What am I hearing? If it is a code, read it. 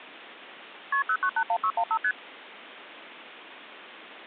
Multi-frequency trunk signalling (R1, as on North American trunks), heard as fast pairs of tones, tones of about 70 ms. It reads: KP 0981615 ST